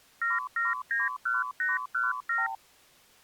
Multi-frequency trunk signalling (R2, with the far end's replies), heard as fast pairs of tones, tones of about 170 ms. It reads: 7791817